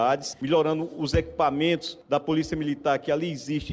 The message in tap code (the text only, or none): none